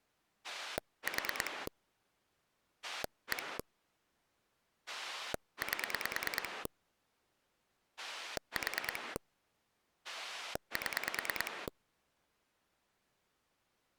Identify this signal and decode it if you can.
Pulse dialling, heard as a rotary dial, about 9 pulses a second. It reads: 4 1 8 4 7